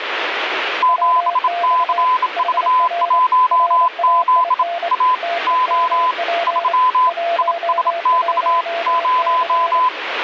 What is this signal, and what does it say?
Morse code, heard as two keyed tones, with radio static. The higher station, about 27 wpm, 1010 Hz: 7CV1Z A O 3 ISX 0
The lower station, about 26 wpm, 690 Hz: WX HR RAIN TEMP 11C